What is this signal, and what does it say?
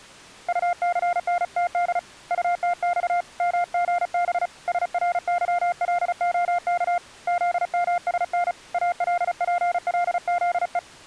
Morse code, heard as a keyed tone, hand-sent with a paddle, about 35 wpm, 700 Hz. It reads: UCNTD UTX MGB SRYLOK ZMSN ALPLZE